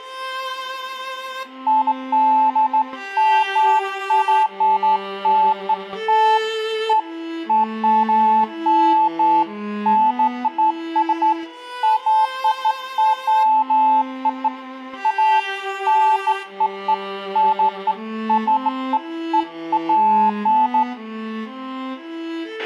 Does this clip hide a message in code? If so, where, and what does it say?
No, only beeps of irregular length, with a squelch burst at the end and room echo.